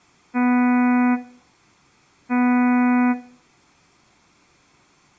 Ship horn signal, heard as a ship's horn, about 250 Hz, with room echo. 2 short. At sea: I am altering course to port.